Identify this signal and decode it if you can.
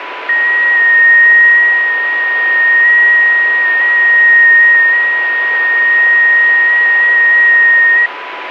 FT8 (one signal), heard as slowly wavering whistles, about 6.25 baud, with radio static and a steady whistle near 990 Hz.